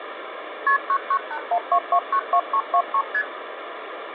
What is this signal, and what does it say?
Multi-frequency trunk signalling (R1, as on North American trunks), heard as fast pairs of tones, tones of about 70 ms, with phone line noise. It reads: KP 99812292323 ST